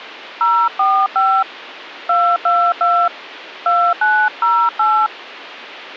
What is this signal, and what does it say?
DTMF, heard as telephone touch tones, dialled by hand, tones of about 270 ms. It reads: 045 222 2908